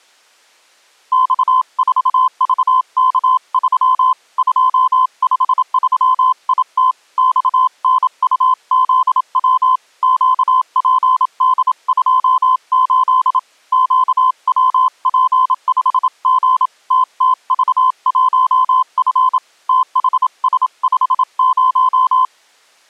Morse code, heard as a keyed tone, hand-sent with a paddle, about 27 wpm, 1030 Hz. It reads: X4VK3 253IT XNUZW QPD28 QWP5G TTV1F THS50